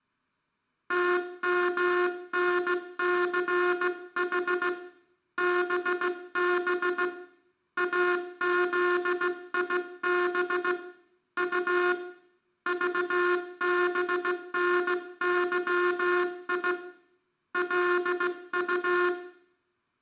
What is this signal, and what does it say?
Morse code, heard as a buzzer, hand-sent with a straight key, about 16 wpm, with room echo. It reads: TMNCH BB AZIB U VBNYI LU